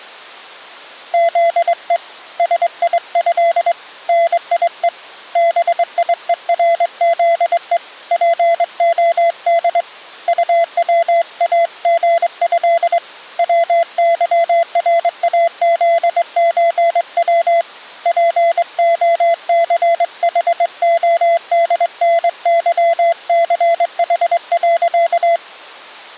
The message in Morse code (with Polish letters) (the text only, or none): ZE SIĘ NIE BIERZE POD UWAGĘ WYRAZÓW POCHODNYCH.